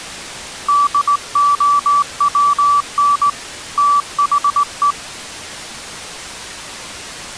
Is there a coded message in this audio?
Yes: Morse code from 0.6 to 5.0 s, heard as a keyed tone, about 18 wpm, 1160 Hz. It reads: DOWN THE